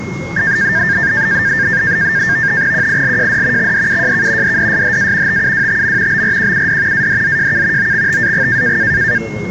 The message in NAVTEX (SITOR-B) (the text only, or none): QILJD XDUJK DDSHA TUWTM BRQUD ADZJK OXTAG